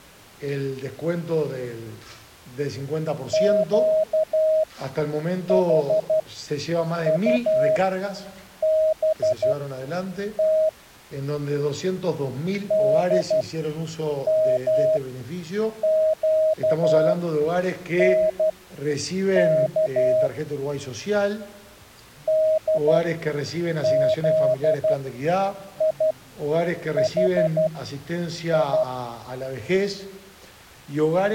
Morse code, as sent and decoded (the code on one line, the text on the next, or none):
--.- .... ..- -... - / -.. -- --.- -. -.- / -.. --.. .. .... ..
QHUBT DMQNK DZIHI